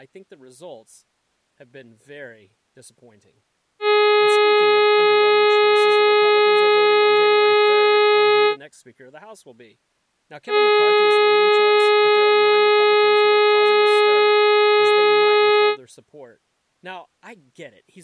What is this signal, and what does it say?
Ship horn signal, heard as a ship's horn, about 420 Hz, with speech in English. 2 long. At sea: a vessel under power that has stopped in fog.